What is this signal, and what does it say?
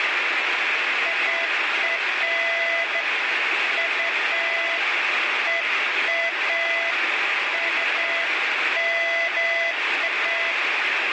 Beeps of irregular length, with heavy radio static. There is no code.